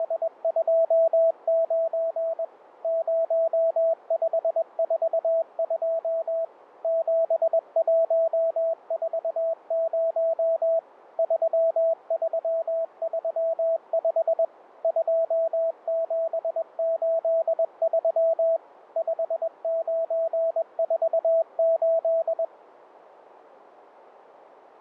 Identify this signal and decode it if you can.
Morse code, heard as a keyed tone, machine-sent, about 21 wpm, 660 Hz, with radio static. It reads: … 0542 7140 3335 2783 5948